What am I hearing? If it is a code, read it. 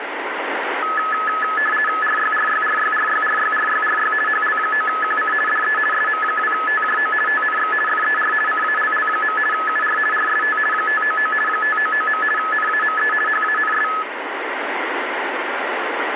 RTTY (50 baud, 450 Hz shift), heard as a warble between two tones, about 1500 Hz centre, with radio static. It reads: RYRYRYRYRYRYRY HL9QC DE SM2TJO TNX FER CALL. UR RST 599 599. NAME HANS